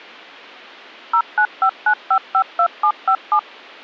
DTMF, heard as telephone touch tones, dialled by machine, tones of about 80 ms. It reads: 0959552757